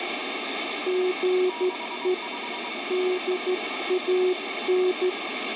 Morse code, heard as two keyed tones, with heavy radio static. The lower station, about 13 wpm, 370 Hz: GE DAN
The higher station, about 23 wpm, 960 Hz: 65